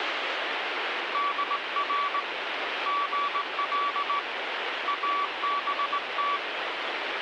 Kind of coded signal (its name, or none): Morse code